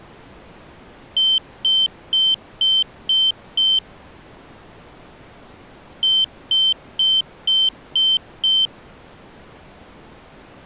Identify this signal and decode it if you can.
Beep code, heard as a piezo beeper, played twice, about 3100 Hz. 6 short. In AMI BIOS tables: keyboard controller gate A20 failure; in Dell tables: video card failure.